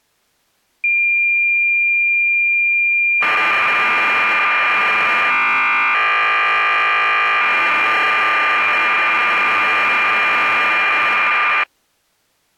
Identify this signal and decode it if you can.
Cassette data (Kansas City type), 1200 baud, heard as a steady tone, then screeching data.